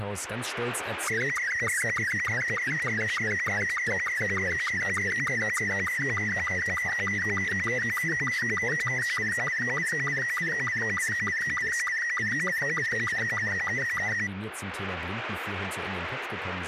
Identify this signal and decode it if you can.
SSTV (slow-scan television), Robot 72, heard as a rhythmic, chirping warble, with radio static and speech in German.